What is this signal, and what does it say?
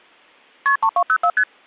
Multi-frequency trunk signalling (R1, as on North American trunks), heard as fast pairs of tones, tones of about 70 ms. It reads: KP 3204 ST